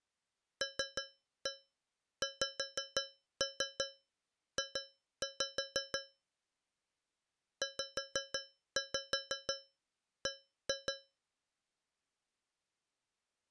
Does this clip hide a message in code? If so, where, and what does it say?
Yes: tap code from 0.6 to 11.2 s, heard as taps on a metal pipe, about 5 knocks a second. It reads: LXJ ZB